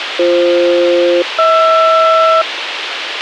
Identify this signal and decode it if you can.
Aircraft SELCAL, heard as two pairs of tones, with radio hiss and a squelch burst at the end. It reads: BF-HR